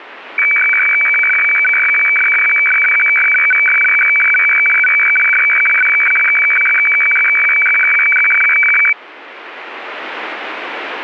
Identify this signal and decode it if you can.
Weather fax (radiofax), 120 lines a minute, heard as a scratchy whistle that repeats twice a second.